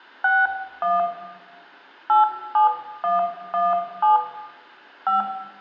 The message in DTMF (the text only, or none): 61 87117 5